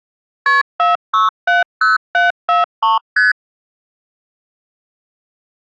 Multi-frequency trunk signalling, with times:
0.5-0.6 KP
0.8-3.0 4670743
3.2-3.3 ST

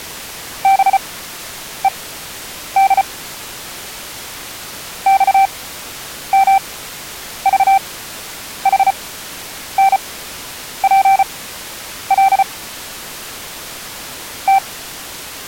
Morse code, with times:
0.6-3.0 BED
5.1-12.4 XMVHNPL
14.5-14.6 T

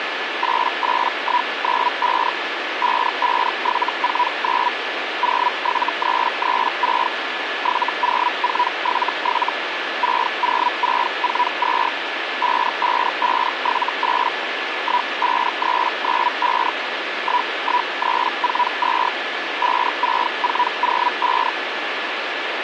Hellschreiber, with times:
0.4-2.3 88195
2.8-4.7 55749
5.2-7.1 07336
7.6-9.5 70477
10.0-11.9 60642
12.4-14.3 55578
14.8-16.7 15395
17.2-19.1 11342
19.6-21.5 56405

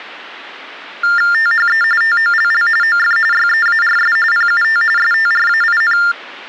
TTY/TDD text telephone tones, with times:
1.3-1.8 THE
2.0-2.7 TOLL
2.8-3.2 OF
3.3-4.2 YEARS
4.3-4.8 PUT
5.0-6.0 STRAIN

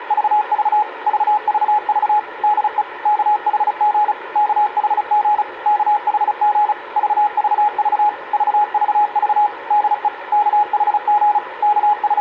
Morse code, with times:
0.0-0.8 …
1.1-2.2 VVV
2.4-2.8 DE
3.1-4.1 KHG
4.4-5.4 KHG
5.7-6.7 KHG
7.0-8.1 VVV
8.3-9.5 VVV
9.7-10.1 DE
10.3-11.4 KHG
11.6-12.2 …

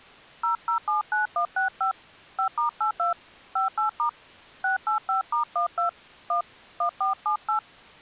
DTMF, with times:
0.4-1.9 0079165
2.4-3.1 5*82
3.6-4.1 58*
4.6-5.9 685*12
6.3-6.4 1
6.8-7.6 1478

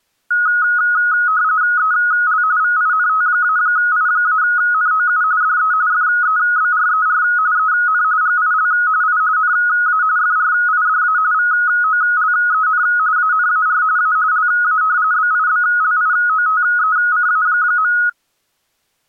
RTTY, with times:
1.8-2.4 EL
2.6-5.2 VINT-I-NOU
5.4-5.7 DE
5.9-7.2 FEBRER
7.6-8.0 EN
8.2-8.7 GIL
9.0-9.2 I
9.4-10.0 NA
10.2-11.2 FRIDA
11.3-12.8 VOLEN
13.2-13.8 ANAR
14.0-14.2 A
14.3-14.8 LA
15.1-17.9 BIBLIOTECA.

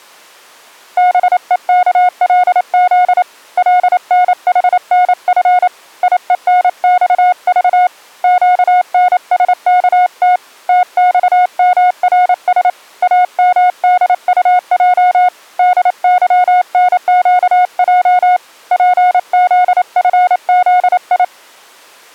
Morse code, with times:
1.0-3.2 BEKLZ
3.6-5.7 LNHNF
6.0-7.9 IENXV
8.2-10.4 QNSKT
10.7-12.7 TXMRS
13.0-15.3 AMDUJ
15.6-18.4 DYNQJ
18.7-21.2 PZFZI

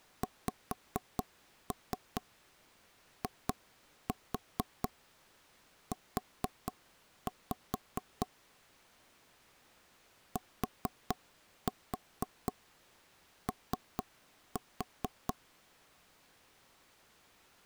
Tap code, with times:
0.2-8.3 XIU
10.4-15.3 TO

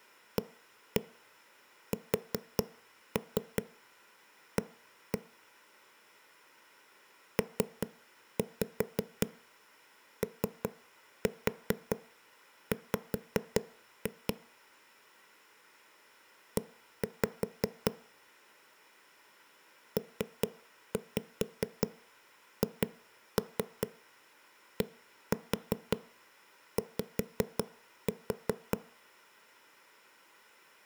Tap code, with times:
0.4-5.2 ASA
7.4-14.3 POW
16.6-17.9 E
20.0-28.8 PHDY

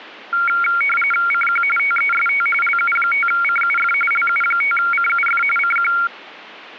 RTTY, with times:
1.3-1.6 CQ
1.8-2.5 TEST
2.6-3.9 LU5CUF
4.1-5.4 LU5CUF
5.6-5.9 CQ

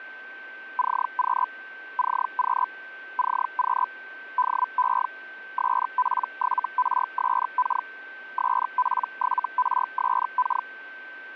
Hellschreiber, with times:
0.8-1.5 CQ
2.0-2.7 CQ
3.2-3.9 CQ
4.4-5.1 DE
5.6-7.9 SP7RSK
8.4-10.7 SP7RSK

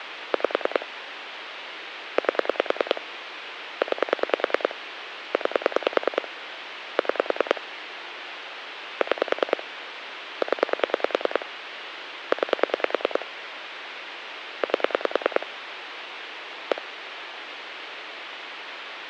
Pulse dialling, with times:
0.3-0.9 5
2.2-3.0 8
3.8-4.8 9
5.3-6.3 9
7.0-7.6 6
9.0-9.6 6
10.4-11.5 0
12.3-13.3 9
14.6-15.5 8
16.7-16.8 1

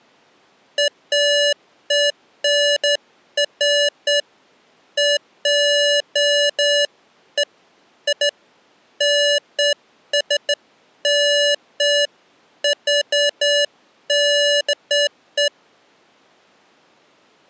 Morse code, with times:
none

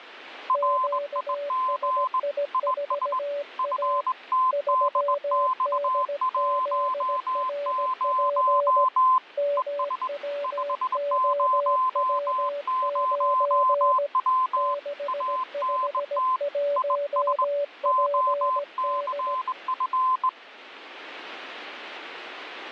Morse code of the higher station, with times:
0.5-2.2 RIG
2.5-3.2 IS
3.6-9.2 FTDX10
9.6-10.1 ES
10.4-14.7 500W
15.1-16.4 ANT
16.8-17.4 IS
17.9-20.3 OCF

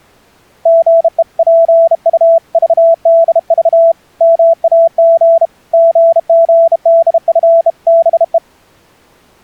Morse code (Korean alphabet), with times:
0.7-3.9 사지를
4.2-5.5 못
5.7-8.4 쓴다

